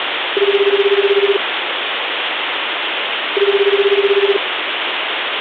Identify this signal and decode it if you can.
Telephone call progress tone (Japanese plan), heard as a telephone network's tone, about 380, 400, 420 Hz, 1 s on and 2 s off, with phone line noise. Ringback tone.